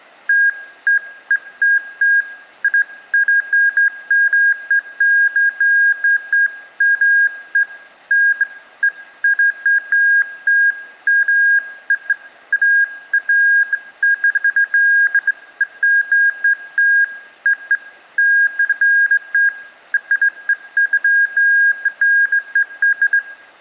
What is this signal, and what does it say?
Beeps of irregular length, with room echo. There is no code.